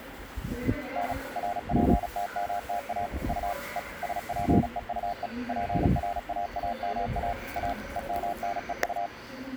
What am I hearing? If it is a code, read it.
Morse code, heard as a keyed tone, machine-sent, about 36 wpm, 700 Hz, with the noise of a subway station. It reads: N RPTMTA U E SPEUE PRAAMA A EMNEU